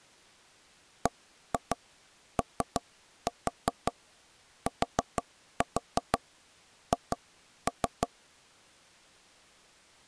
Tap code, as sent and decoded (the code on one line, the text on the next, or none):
1-2 3-4 4-4 2-3
BOTH